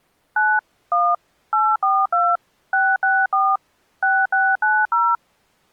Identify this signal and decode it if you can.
DTMF, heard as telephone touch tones, dialled by machine, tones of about 230 ms. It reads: 9 1 842 664 6690